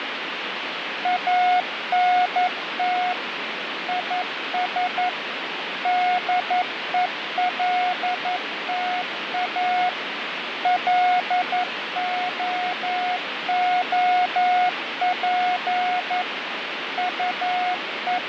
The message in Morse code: ANT IS DELTA LOOP …

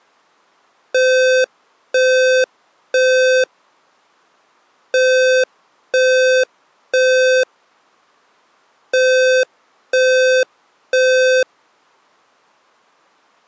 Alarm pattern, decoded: temporal three

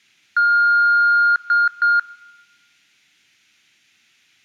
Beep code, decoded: 1 long, 2 short

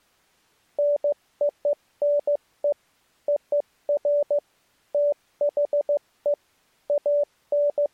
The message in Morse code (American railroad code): NONE OF THE …

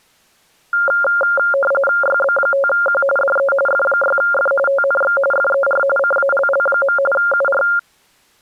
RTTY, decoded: YB5Q DE F6F TNX FER CALL. UR

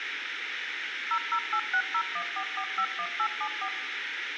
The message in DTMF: 0086014451874

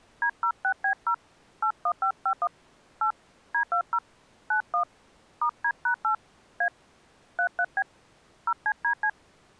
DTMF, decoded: D06B0 81551 8 D20 91 *D#8 A 33B 0CDC

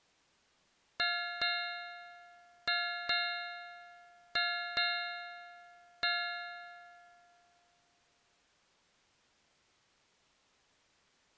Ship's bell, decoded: 7

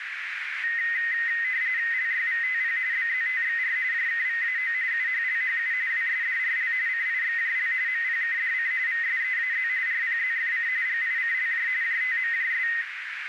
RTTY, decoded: LYVTP BZTXR JKVAO UHLHU WSDRL CIXJL MPKDC VSEAZ RPZFC GICLJ JTMJS

